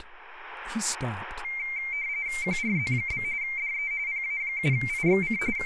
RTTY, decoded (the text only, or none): QRZ? DE PA7IXC …